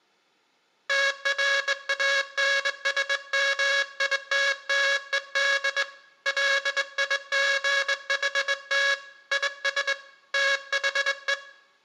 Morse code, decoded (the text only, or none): TRANSMITTED LIGHT IS THE